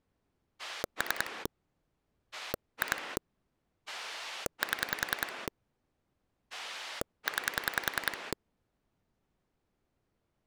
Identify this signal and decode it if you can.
Pulse dialling, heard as a rotary dial, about 10 pulses a second. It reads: 3 2 7 9